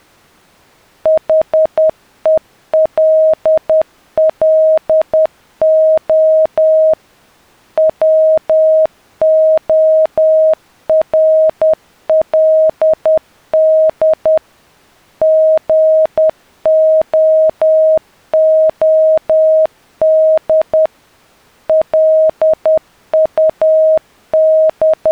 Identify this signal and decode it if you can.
Morse code, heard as a keyed tone, machine-sent, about 10 wpm, 630 Hz. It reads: HELLO WORLD GOOD …